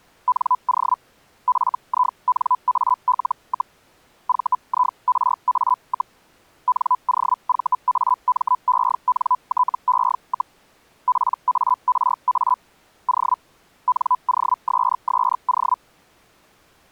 Hellschreiber (Feld-Hell, 122.5 baud), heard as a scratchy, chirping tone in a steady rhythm, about 1000 Hz. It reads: NO FINAL, VIRA, NOVAMENTE, PARA O NOSSO